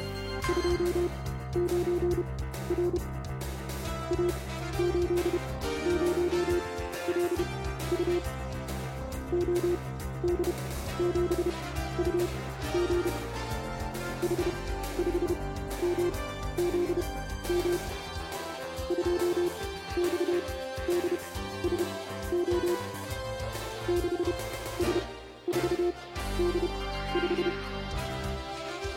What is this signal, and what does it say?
Morse code, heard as a keyed tone, machine-sent, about 31 wpm, spaced as for 14 wpm, 350 Hz. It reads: … A80LU OD7UG H5MZM 2XDSO 6S4D5